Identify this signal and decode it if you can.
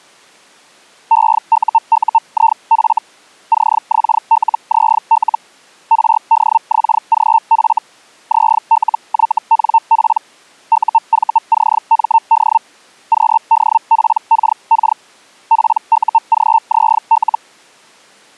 Hellschreiber (Feld-Hell, 122.5 baud), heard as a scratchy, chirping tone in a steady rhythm, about 900 Hz. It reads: EUUIF CXLZL RDXGF ZLYNP UVCMD QDPKK PUGZL